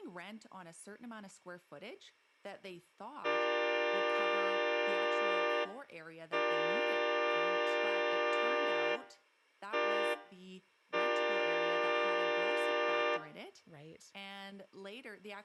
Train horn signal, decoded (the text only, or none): 2 long, 1 short, 1 long